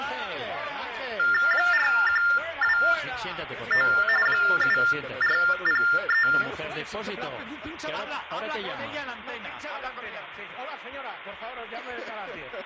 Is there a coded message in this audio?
Yes: TTY/TDD text telephone tones (45.45 baud Baudot) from 1.2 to 6.4 s, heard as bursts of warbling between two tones, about 400 Hz shift, 1600 Hz centre, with room echo. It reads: 4129 7403